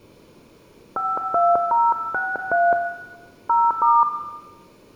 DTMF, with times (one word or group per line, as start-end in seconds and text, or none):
1.0-2.7 52063
3.5-4.0 0*